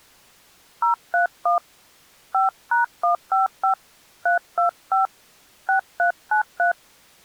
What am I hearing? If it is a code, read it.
DTMF, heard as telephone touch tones, dialled by hand, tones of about 130 ms. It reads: 031 5#155 325 6393